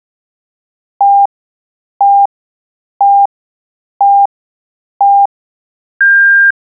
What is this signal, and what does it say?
Radio time signal (five pips and a higher one, as on Chinese radio), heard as pips.